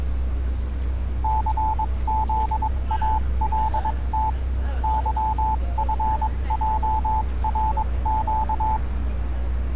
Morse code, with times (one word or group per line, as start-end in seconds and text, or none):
1.2-4.3 CZALT
4.8-8.8 YFJRQ